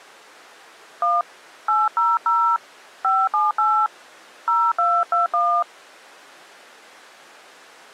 DTMF, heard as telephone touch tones, dialled by hand, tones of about 240 ms. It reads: 1 800 578 0221